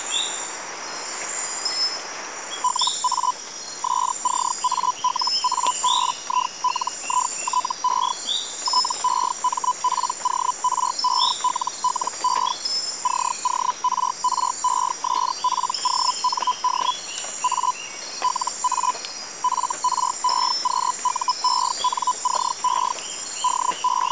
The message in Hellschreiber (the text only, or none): LA SCALABILITE TEMPORELLE CORRESPOND A LA FREQUENCE …